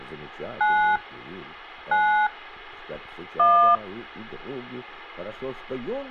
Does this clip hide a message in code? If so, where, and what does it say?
Yes: DTMF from 0.6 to 3.8 s, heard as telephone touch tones, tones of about 250 ms, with hum. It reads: 9 9 1